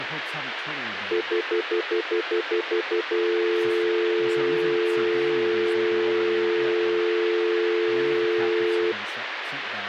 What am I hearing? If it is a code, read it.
Telephone call progress tone (North American plan), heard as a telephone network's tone, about 350, 440 Hz, 0.1 s on and 0.1 s off, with phone line noise and speech in English. Stutter dial tone.